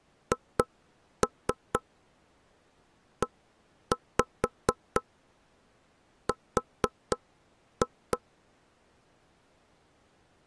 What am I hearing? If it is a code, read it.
Tap code, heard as knocks on wood, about 4 knocks a second. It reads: HER